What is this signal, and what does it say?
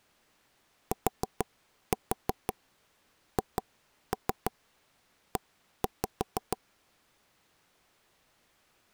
Tap code, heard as knocks on wood, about 6 knocks a second. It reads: THE